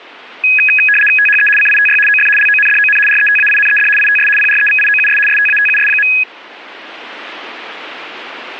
RTTY (75 baud, 850 Hz shift), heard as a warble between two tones, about 2100 Hz centre. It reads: THE CITY OF LONDON RETAINED ITS PREVIOUS STATUS.